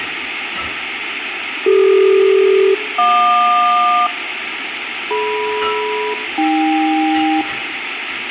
Aircraft SELCAL, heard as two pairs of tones, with radio static, fading and kitchen noise. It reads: CD-JQ DM-AK